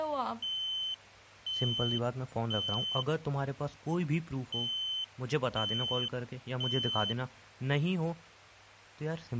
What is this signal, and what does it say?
Alarm pattern, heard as an alarm's beeps, played twice, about 3050 Hz, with speech in Hindi. Temporal three. Smoke or fire, evacuate.